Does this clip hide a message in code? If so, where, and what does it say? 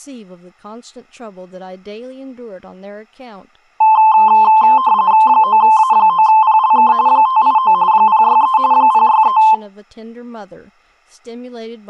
Yes: RTTY (45.45 baud, 170 Hz shift) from 3.8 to 9.5 s, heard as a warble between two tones, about 960 Hz centre, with speech in English. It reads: 9A9PLK 589 063 063